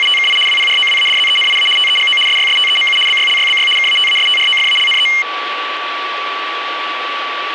RTTY (75 baud, 850 Hz shift), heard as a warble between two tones, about 2550 Hz centre, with radio static and a steady whistle near 1150 Hz. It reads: … WPROWADZENIA TEGO SYSTEMU BYLYBY KATASTROFALNE